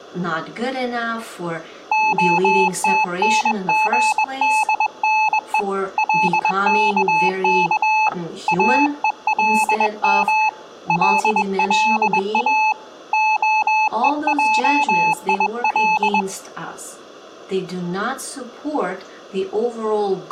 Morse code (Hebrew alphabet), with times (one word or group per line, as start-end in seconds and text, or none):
1.9-5.6 התנגדנו
6.0-8.1 לכך
8.5-10.5 אולם
10.9-12.7 ללא
13.1-16.2 הועיל